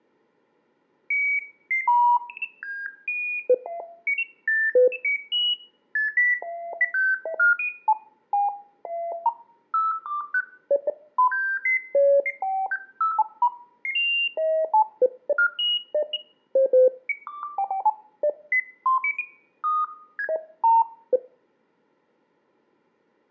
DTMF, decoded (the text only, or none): none